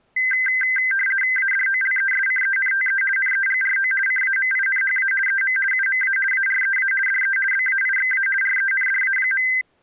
RTTY (50 baud, 450 Hz shift), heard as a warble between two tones, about 1800 Hz centre. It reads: ADOLESCENTE NEGRO CAMINHA EM UMA AREA DE BAIXA RENDA.